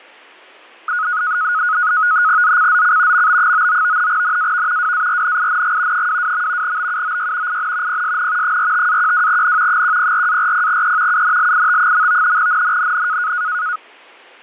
NAVTEX (SITOR-B), 100 baud, 170 Hz shift, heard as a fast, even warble, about 1360 Hz centre. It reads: ZCZC MB99 NAV WARNING 22. BUOY IN PSN 45-12N 104-40E UNLIT. NNNN